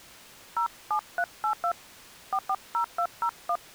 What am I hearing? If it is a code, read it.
DTMF, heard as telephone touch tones, dialled by hand, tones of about 70 ms. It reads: 07382 440201